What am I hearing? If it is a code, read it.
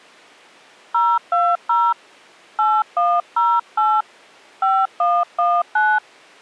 DTMF, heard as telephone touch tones, dialled by hand, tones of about 240 ms. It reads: 020 8108 5119